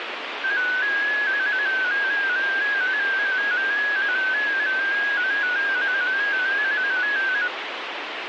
Multi-tone FSK (Olivia or MFSK type), about 250 Hz wide, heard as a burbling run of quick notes, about 15.625 baud, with radio static.